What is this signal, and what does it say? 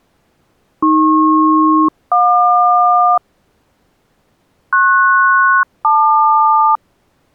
Aircraft SELCAL, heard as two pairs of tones. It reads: AP-JQ PS-LQ